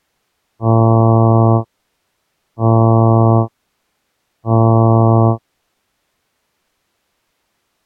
Ship horn signal, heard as a ship's horn, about 110 Hz. 3 short. At sea: I am operating astern propulsion.